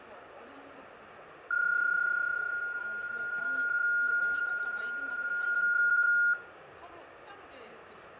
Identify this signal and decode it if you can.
PSK31 (31.25 baud), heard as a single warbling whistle, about 1420 Hz, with radio static, fading and the noise of a crowd indoors.